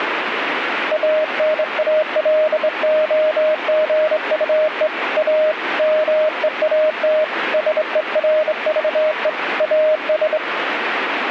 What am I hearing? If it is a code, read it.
Morse code, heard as a keyed tone, hand-sent with a straight key, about 25 wpm, 620 Hz, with radio static. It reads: ANALOGUE A MEAT SERVE AS